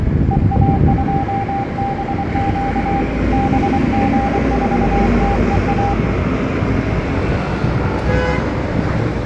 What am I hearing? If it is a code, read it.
Morse code, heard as a keyed tone, hand-sent with a paddle, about 24 wpm, 800 Hz, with room echo and street noise. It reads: EA2BQ BG4TEA